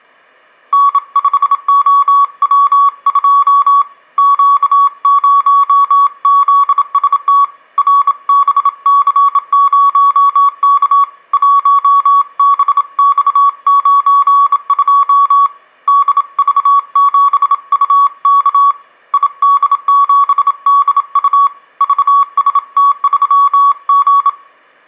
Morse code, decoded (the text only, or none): N5OW2 Q0ZST RBC0K 1BX92 DV7UK ID7DU VST3G